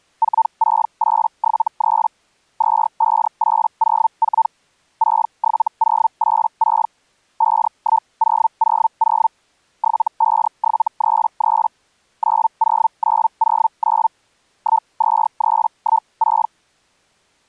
Hellschreiber (Feld-Hell, 122.5 baud), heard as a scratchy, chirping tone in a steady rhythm, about 900 Hz. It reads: 46873 25804 67086 51000 75733 90909 12316